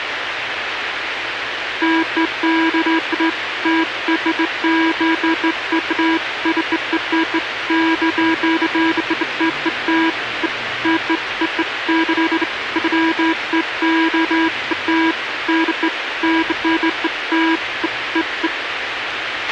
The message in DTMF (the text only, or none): none